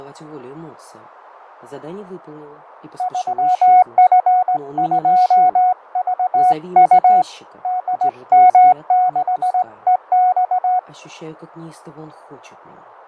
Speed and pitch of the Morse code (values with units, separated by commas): 18 wpm, 730 Hz